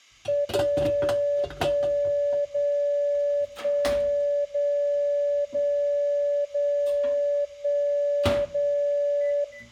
Radio time signal (DCF77), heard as a tone whose level steps once a second, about 580 Hz, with room echo and kitchen noise. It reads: 0 1 0 1 0 0 0 1 0